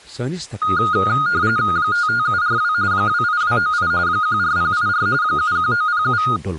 RTTY (45.45 baud, 170 Hz shift), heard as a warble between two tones, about 1340 Hz centre, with speech in Kashmiri. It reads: 55742 28298 14084 71907